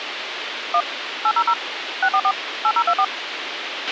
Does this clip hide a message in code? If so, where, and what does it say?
Yes: DTMF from 0.7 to 3.0 s, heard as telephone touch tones, dialled by machine, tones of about 60 ms, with radio hiss and a squelch burst at the end. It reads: 1 800 644 8024